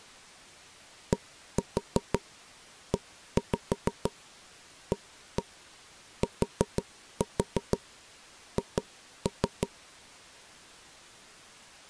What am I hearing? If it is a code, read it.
Tap code, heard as knocks on wood, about 6 knocks a second. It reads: DEATH